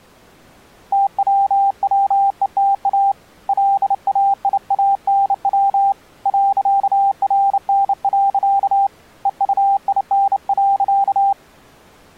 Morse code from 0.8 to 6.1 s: TWWETA LAIANW

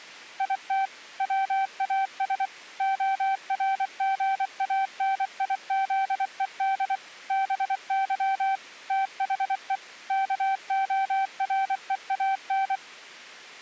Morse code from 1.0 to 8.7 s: WAS ORGANIZED BY

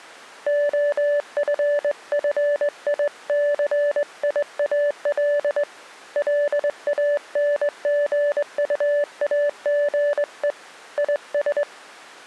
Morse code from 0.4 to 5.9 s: OFFICIAL

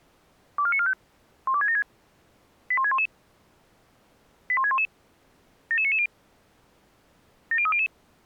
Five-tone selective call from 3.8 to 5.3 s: 81611

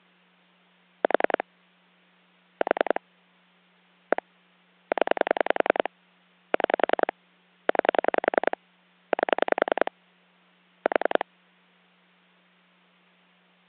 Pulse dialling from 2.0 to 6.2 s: 4 1 0

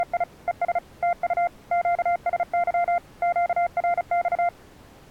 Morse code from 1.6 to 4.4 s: QSY QRX

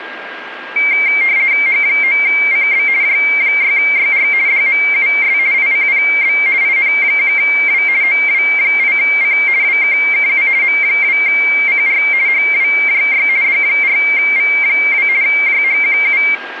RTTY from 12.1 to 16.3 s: HWJY D4V2 JHQU

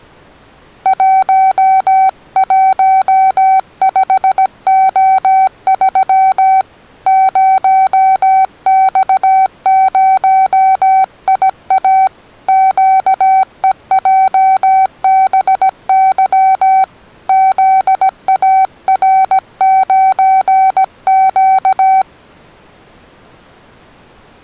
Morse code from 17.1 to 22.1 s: ZAR9Q

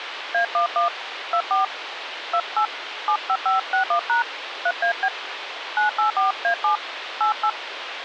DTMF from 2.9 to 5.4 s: 75561# 3AB

